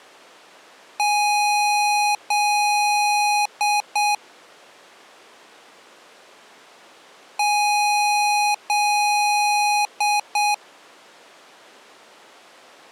Beep code, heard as beeps from a small speaker, played twice, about 830 Hz. 2 long, 2 short.